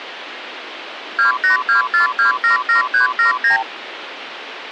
Multi-frequency trunk signalling (R2, with the far end's replies), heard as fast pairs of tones, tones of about 120 ms, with phone line noise. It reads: 2824277379